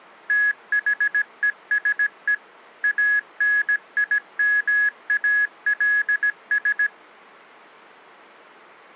Morse code, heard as electronic beeps, machine-sent, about 17 wpm, 1700 Hz. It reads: THESE ANIMALS